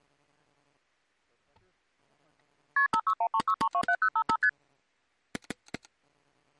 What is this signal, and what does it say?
Multi-frequency trunk signalling (R1, as on North American trunks), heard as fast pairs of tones, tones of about 70 ms. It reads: KP 56136327055 ST